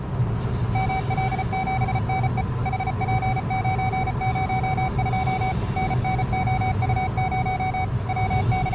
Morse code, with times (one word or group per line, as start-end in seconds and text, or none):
0.8-2.4 ML7NE
2.7-5.5 HP902
5.8-7.8 NNOU0
8.1-8.7 …